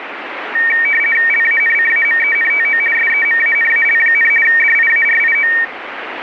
RTTY (50 baud, 450 Hz shift), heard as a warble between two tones, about 2050 Hz centre, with radio static. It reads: LANCAMENTO SEMANAL, DIARIO